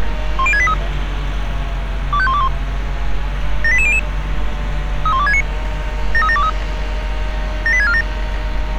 Five-tone selective call (ZVEI), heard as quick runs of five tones, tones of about 70 ms, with street noise. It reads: 10683 25121 78800 31269 73723 78647